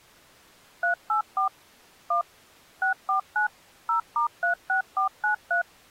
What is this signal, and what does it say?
DTMF, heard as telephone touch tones, dialled by machine, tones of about 110 ms. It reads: 384 1 649 0*36493